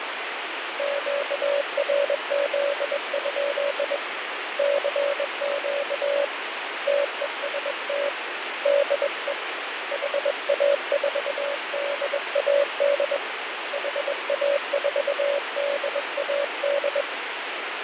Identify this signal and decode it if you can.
Morse code, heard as a keyed tone, hand-sent with a bug key, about 21 wpm, 570 Hz, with radio static and fading. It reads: QRZ? CQ TEST DE HA4DAD HA4DAD